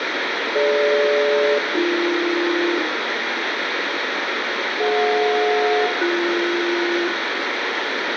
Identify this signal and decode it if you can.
Aircraft SELCAL, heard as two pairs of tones, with heavy radio static and room echo. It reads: DG-AB DJ-BS